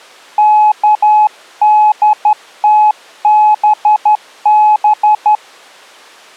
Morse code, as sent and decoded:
-.- -.. - -... -...
KDTBB

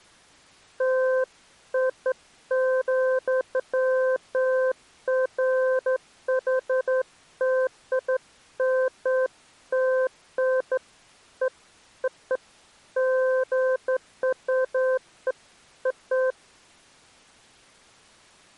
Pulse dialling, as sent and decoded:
none

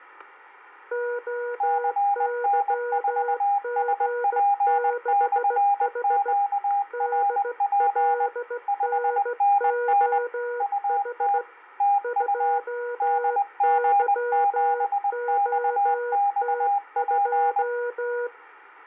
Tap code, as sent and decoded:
none

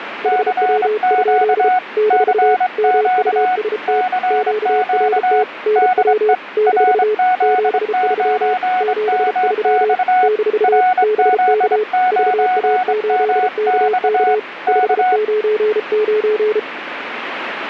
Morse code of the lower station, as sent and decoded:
.... .-- ..--.. / -....- / -- ..- ... - / --.- .-. - / -. .-- / -....- / --... ...-- / --... ...-- / -....- / -... -.- / ...- .- ---.. -.- -.- / ..... ----. ----.
HW? - MUST QRT NW - 73 73 - BK VA8KK 599

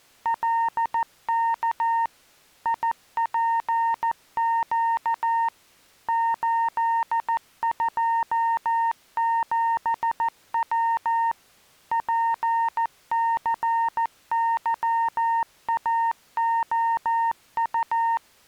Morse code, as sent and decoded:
.-.. -.- / .. .--. --.- / ---.. ..--- --... .-- / .--. -.-. -.-- .- --- ..-
LK IPQ 827W PCYAOU

